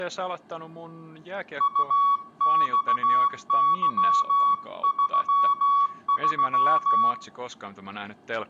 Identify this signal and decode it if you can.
Morse code, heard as a keyed tone, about 16 wpm, 1120 Hz, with room echo and speech in Finnish. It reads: UXY33